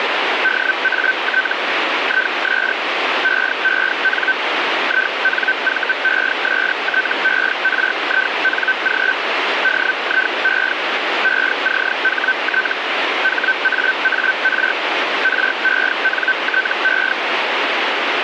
Hellschreiber (Feld-Hell, 122.5 baud), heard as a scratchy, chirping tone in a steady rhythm, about 1550 Hz, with radio static. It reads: DAT IS EEN INVESTERING DIE ECHT HAAR RENTE